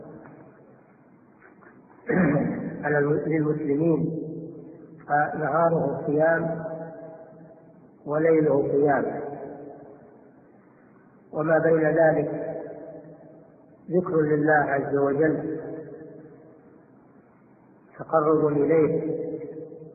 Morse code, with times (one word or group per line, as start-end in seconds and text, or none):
none